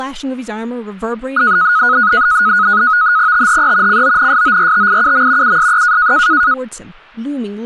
NAVTEX (SITOR-B), 100 baud, 170 Hz shift, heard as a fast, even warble, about 1360 Hz centre, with speech in English. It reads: THE CONSORTIUM USE